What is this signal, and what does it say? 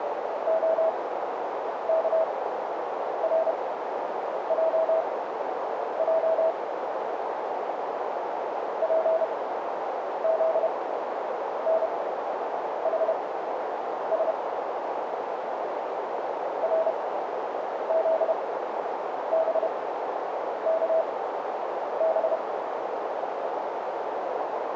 Morse code, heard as a keyed tone, machine-sent, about 31 wpm, spaced as for 8 wpm, 650 Hz, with heavy radio static and a narrow filter. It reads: OKRJJ PZNHS RZBKB